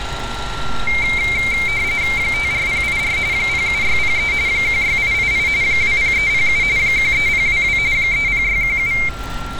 RTTY (45.45 baud, 170 Hz shift), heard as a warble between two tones, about 2200 Hz centre, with a steady whistle near 1370 Hz and street noise. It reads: 54084 07603 16888 20307 13022 30617